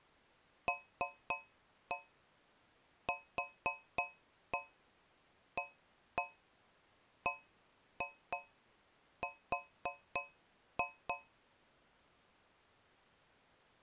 Tap code, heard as taps on a metal pipe, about 3 knocks a second. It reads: LQABR